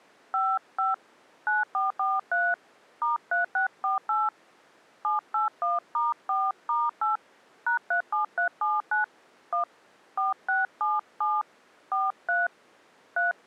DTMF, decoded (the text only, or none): 55 9443 *3648 781*4*8 #37379 1 4677 43 3